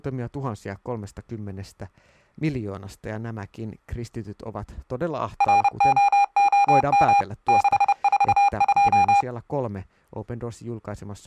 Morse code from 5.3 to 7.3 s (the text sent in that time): ROOM